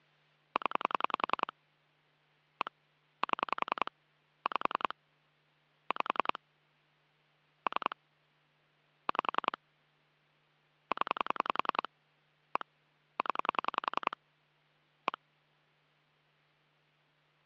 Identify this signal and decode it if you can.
Pulse dialling, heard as clicks on a phone line, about 10 pulses a second. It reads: 0 1 7 5 5 3 5 0 1 0 1